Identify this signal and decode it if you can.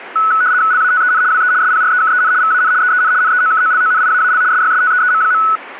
RTTY (75 baud, 170 Hz shift), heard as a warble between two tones, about 1390 Hz centre. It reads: LATEN WE SPREKEN VAN EEN NEOKOLONIAAL SYSTEEM.